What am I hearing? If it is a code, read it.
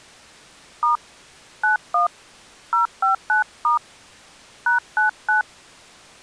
DTMF, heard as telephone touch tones, dialled by hand, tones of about 130 ms. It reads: * 91 059* #99